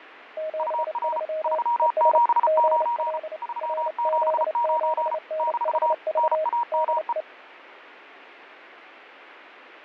Morse code, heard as two keyed tones, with radio static and fading. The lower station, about 29 wpm, 630 Hz: 73 ES GL RZ7NHV DE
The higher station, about 34 wpm, 950 Hz: UR 379 379 - NAME